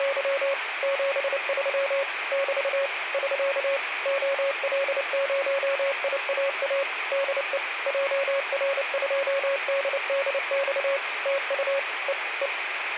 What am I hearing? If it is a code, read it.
Morse code, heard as a keyed tone, machine-sent, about 29 wpm, 550 Hz, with radio static. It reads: … 73 <BT> <SK> OL0IAA DE JR2DDX TU E E